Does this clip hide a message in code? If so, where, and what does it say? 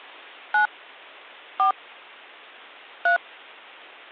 Yes: DTMF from 0.5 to 3.2 s, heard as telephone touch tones, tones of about 110 ms. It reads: 9 4 3